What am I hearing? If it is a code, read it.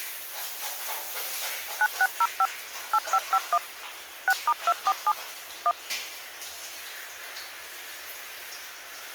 DTMF, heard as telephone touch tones, dialled by machine, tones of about 50 ms, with the noise of a restroom. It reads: 9605 8551 6*247 1